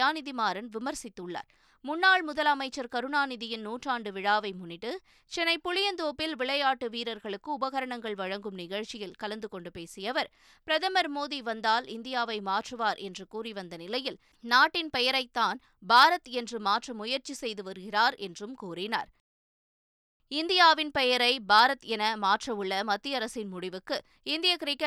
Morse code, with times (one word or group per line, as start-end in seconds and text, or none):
none